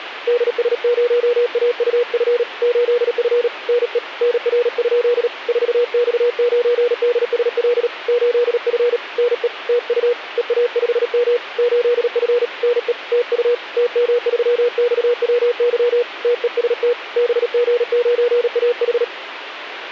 Morse code, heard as a keyed tone, hand-sent with a paddle, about 37 wpm, 480 Hz, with radio static. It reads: DS0AUF 8F NE NR? 4X9DSL 8F NE TU EA5M 8F NE TU TM3XWY TEST BG9AH